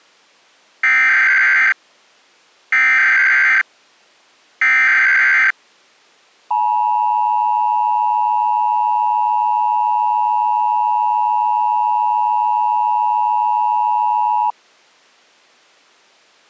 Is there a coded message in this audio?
Yes: Emergency Alert System (SAME) tones (header bursts, then the 853 and 960 Hz attention tone) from 0.8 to 14.5 s, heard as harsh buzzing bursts, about 520.83 baud.